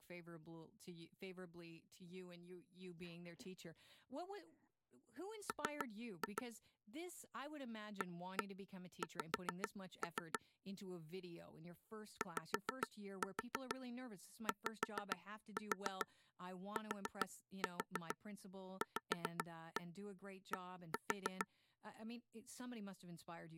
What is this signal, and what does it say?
Tap code, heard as taps on a table, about 6 knocks a second, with speech in English. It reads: M AX YYTVD